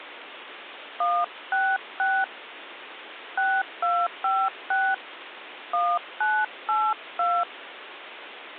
DTMF, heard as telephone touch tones, dialled by hand, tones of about 240 ms, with phone line noise. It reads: 166 6256 1982